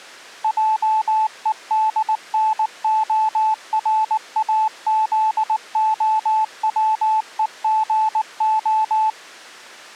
Morse code, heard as a keyed tone, machine-sent, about 19 wpm, 870 Hz. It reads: JEDNORAZOWEGO